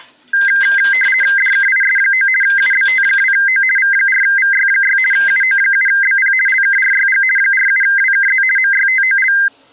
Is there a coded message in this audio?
Yes: RTTY (50 baud, 450 Hz shift) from 0.3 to 9.5 s, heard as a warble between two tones, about 1800 Hz centre, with kitchen noise. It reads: DKIS9 UBT2O V4VY6 UO7BP LKRYG 47WKZ MYTOL